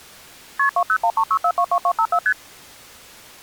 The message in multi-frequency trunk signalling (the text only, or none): KP 20136422254 ST